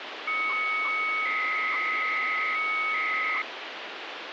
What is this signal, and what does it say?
300-baud modem data (Bell 103 tones), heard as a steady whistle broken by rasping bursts, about 300 baud, 200 Hz shift, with phone line noise.